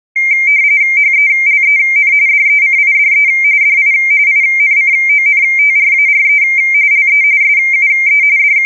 RTTY (45.45 baud, 170 Hz shift), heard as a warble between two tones, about 2200 Hz centre. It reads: HELEN DECIDE DI INCONTRARE LE SUE …